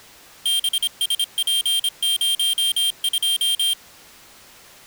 Morse code, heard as a high beeper, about 26 wpm, 3200 Hz. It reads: BSP02